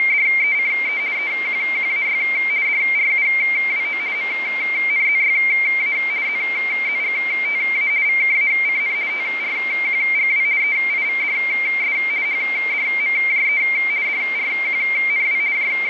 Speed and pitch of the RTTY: 50 baud, 170 Hz shift, 2200 Hz centre

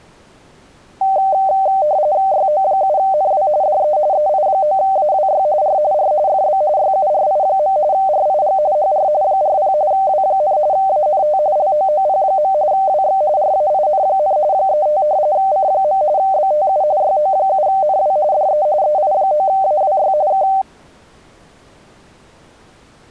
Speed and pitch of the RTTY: 45.45 baud, 170 Hz shift, 690 Hz centre

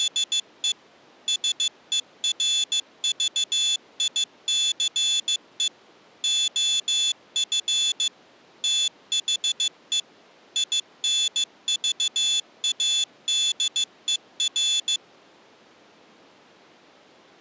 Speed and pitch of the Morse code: 15 wpm, 3450 Hz

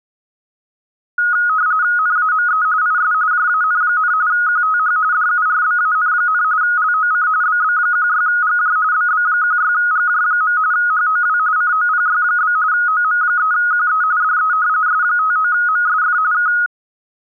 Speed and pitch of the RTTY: 45.45 baud, 170 Hz shift, 1360 Hz centre

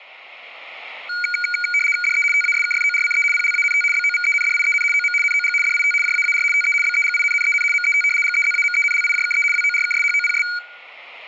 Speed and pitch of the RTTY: 75 baud, 850 Hz shift, 1850 Hz centre

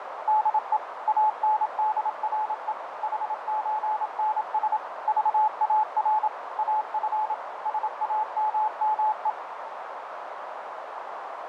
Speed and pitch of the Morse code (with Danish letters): 27 wpm, 860 Hz

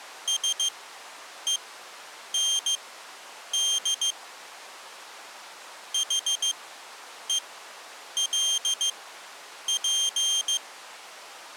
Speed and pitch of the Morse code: 15 wpm, spaced as for 8 wpm, 3200 Hz

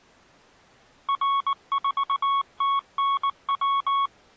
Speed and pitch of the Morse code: 19 wpm, 1110 Hz

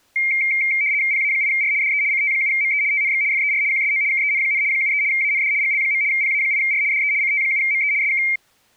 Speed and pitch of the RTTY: 75 baud, 170 Hz shift, 2200 Hz centre

